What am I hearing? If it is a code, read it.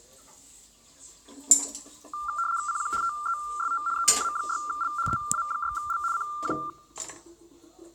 RTTY (75 baud, 170 Hz shift), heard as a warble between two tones, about 1280 Hz centre, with kitchen noise. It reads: CQ TEST EA6L EA6L CQ